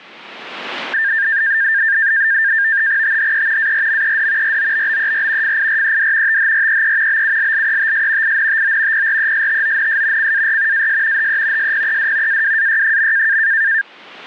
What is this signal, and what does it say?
NAVTEX (SITOR-B), 100 baud, 170 Hz shift, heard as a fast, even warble, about 1700 Hz centre. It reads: THE ARMED ROBBER FIRED THREE BULLETS INTO PRESTONS CAR AS HE SPED AWAY.